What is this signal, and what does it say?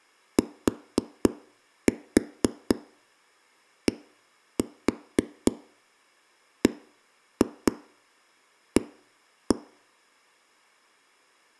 Tap code, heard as knocks on a wall, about 4 knocks a second. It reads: TDBA